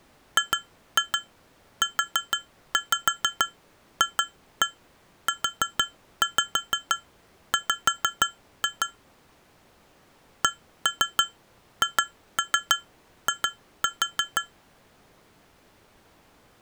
Tap code, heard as taps on glass, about 6 knocks a second. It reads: GUFUW CHI